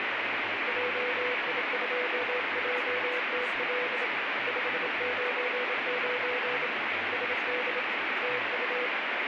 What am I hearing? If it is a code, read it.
Morse code, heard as a keyed tone, hand-sent with a bug key, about 27 wpm, 500 Hz, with heavy radio static and speech in English. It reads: JI2JTL 599 SD TU